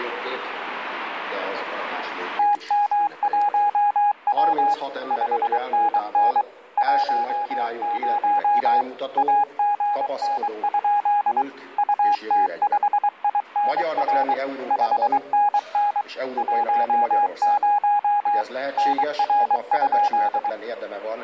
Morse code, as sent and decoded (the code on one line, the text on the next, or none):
- -- .---- .-- / ..... -. -. / .---- ----- / .- --. -. ..--.. / ..- - ..... .. -. .-. / ..... -. -. / .---- ----- / -. .-. ..--..
TM1W 5NN 10 AGN? UT5INR 5NN 10 NR?